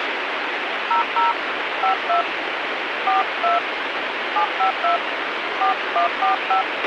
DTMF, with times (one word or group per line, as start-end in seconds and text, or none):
0.9-1.3 00
1.8-2.2 52
3.1-3.6 42
4.4-5.0 752
5.6-6.6 4145